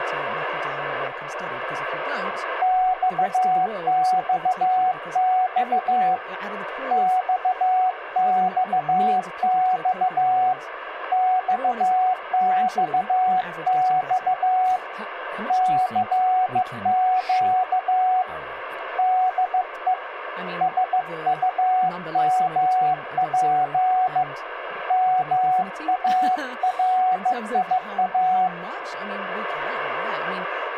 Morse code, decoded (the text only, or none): XXX XXX XXX CQ DE SUMP MARIA